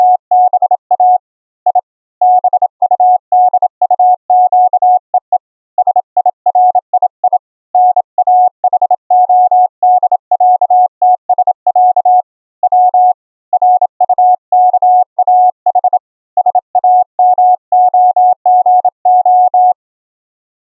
Morse code (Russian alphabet), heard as a keyed tone, hand-sent with a bug key, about 27 wpm, 730 Hz. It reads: … И БУДУЩЕЕ СИРИИ НАХОДЯТСЯ В РУКАХ САМОГО